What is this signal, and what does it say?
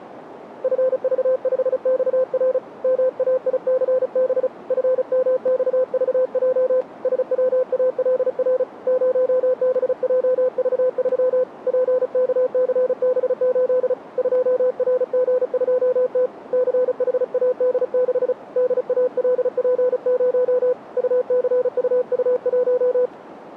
Morse code, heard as a keyed tone, hand-sent with a paddle, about 35 wpm, 510 Hz, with radio static. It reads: FV5XR MAICB FMXVJ SWALR 0BJV3 PKCB8 2RG2T CHAD6 DALP0 UCUU1